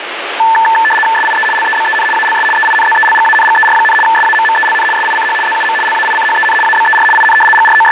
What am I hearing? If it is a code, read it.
RTTY (75 baud, 850 Hz shift), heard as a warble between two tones, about 1320 Hz centre, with radio static. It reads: SIE LEBEN ALS EINZELGANGER, SAMMELN SICH ZUM LAICHEN ABER IN …